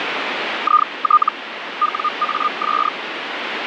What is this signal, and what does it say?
Hellschreiber (Feld-Hell, 122.5 baud), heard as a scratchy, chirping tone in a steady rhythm, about 1220 Hz, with radio static. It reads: IT WAS